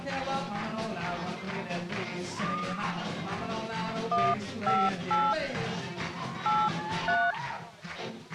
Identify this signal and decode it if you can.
DTMF, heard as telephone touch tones, dialled by hand, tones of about 230 ms. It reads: 158 83